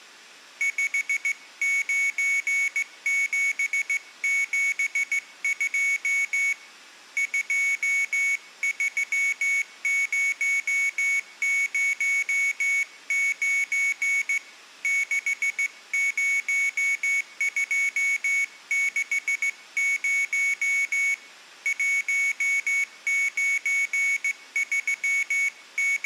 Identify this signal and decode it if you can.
Morse code, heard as a high beeper, hand-sent with a straight key, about 16 wpm, 2250 Hz. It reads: 59772 23009 60260 …